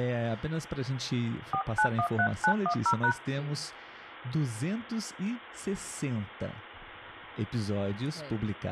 DTMF, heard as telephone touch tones, dialled by hand, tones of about 80 ms, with phone line noise and speech in Portuguese. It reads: 4913910#